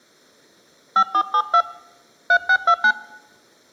DTMF, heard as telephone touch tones, dialled by hand, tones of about 70 ms. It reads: 5472 3629